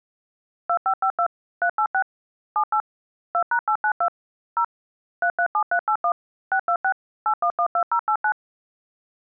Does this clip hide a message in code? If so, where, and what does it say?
Yes: DTMF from 0.7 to 8.3 s, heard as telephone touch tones, dialled by machine, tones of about 80 ms. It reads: 2552 386 78 2#892 0 337381 626 8112089